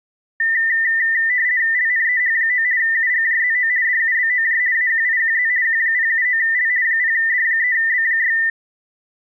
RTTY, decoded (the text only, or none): LNEH9 UGJZO DUBOJ AQIQZ Q079L 0D3B6